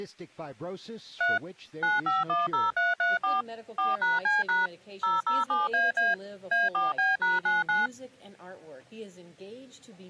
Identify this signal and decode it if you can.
DTMF, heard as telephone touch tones, dialled by machine, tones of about 170 ms. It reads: 3 9510334 4#C# 007AA A4B#99